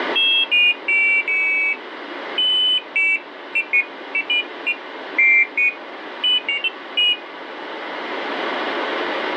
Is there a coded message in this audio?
No, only pairs of high tones at irregular times.